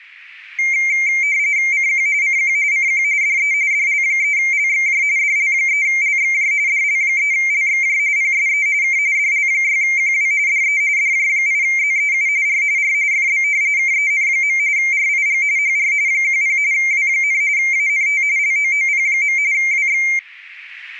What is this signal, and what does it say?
RTTY (45.45 baud, 170 Hz shift), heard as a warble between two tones, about 2200 Hz centre. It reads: CQ CQ CQ DE DL3LXJ DL3LXJ DL3LXJ PSE K DL6QW DE DJ8ZEU R R FB KEN. RIG HR 10 W, ANT LOOP. WX